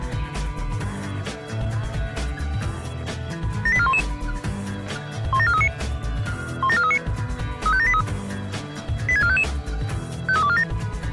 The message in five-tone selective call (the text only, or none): 78411 17439 17439 35783 86455 53247